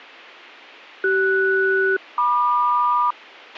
Aircraft SELCAL, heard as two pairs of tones, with a squelch burst at the end. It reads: CS-MQ